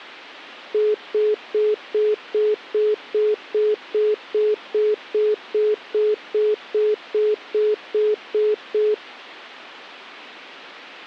Telephone call progress tone (single-tone plan, as in most of Europe), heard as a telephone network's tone, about 420 Hz, 0.2 s on and 0.2 s off. Congestion tone.